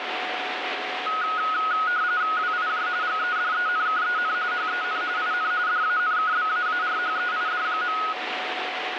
RTTY (45.45 baud, 170 Hz shift), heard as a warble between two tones, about 1360 Hz centre, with radio static and a steady whistle near 740 Hz. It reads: WIJ GEDENKEN HEN IN DANKBAARHEID.